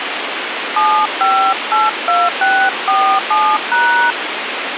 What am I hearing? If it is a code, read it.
DTMF, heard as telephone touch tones, dialled by hand, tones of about 280 ms, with phone line noise. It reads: 7582647#